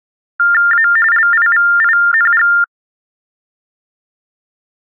TTY/TDD text telephone tones (45.45 baud Baudot), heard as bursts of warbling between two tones, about 400 Hz shift, 1600 Hz centre. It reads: A LIVING